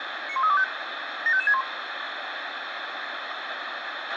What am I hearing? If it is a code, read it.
Five-tone selective call (ZVEI), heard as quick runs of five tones, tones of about 70 ms, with radio hiss and a squelch burst at the end. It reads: 91325 75561